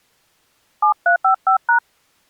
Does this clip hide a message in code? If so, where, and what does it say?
Yes: DTMF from 0.8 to 1.8 s, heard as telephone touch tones, dialled by hand, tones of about 100 ms. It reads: 7355#